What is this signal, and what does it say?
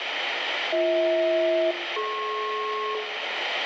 Aircraft SELCAL, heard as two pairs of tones, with radio static and room echo. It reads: BH-DP